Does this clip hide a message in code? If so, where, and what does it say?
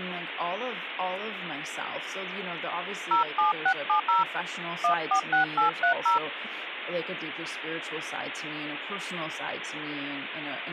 Yes: DTMF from 3.1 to 6.2 s, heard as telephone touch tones, dialled by hand, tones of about 120 ms, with phone line noise and speech in English. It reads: 07670 146830